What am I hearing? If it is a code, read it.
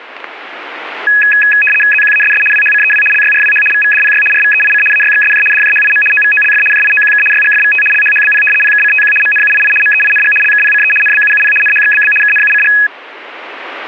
RTTY (75 baud, 850 Hz shift), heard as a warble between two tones, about 2100 Hz centre, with static crashes. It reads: ZQASS WHCEW LYRWH VVDPY RVEIC AYXSJ DJHIM OVOLF JIOQK YGFVT LHHBP PKCTQ MNUII MEING LKPCE NBUUP NHXBB KNUCG